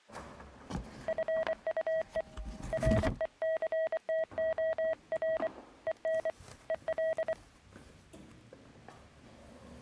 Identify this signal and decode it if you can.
Morse code, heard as a keyed tone, hand-sent with a paddle, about 24 wpm, 640 Hz, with the noise inside a lift. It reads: FUE RECTOR EN EL